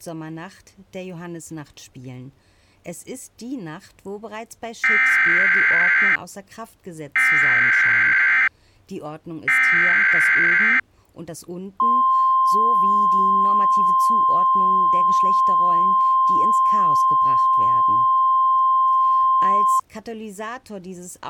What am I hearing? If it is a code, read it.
Emergency Alert System (SAME) tones (header bursts, then the 1050 Hz attention tone), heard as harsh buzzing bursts, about 520.83 baud.